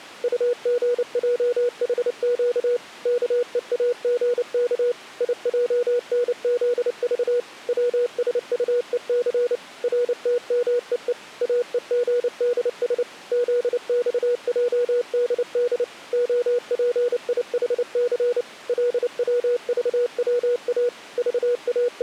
Morse code, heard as a keyed tone, machine-sent, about 29 wpm, 480 Hz. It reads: UGJHQ KEAGK IJNZV WSUEC RTMEE AEGDS ZXJDD OPIHC LWVWA …